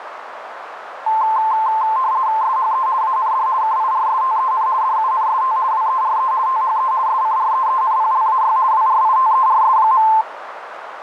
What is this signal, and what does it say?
RTTY (50 baud, 170 Hz shift), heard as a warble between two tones, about 960 Hz centre, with radio static and a narrow filter. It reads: SHE AND KIRSTEN DUNST WERE THE SCREENPLAY WRITERS.